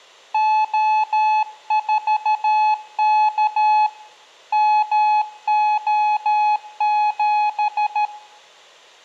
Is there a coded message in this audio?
Yes: Morse code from 0.3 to 8.1 s, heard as a keyed tone, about 13 wpm, 850 Hz, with room echo. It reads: O4K MO7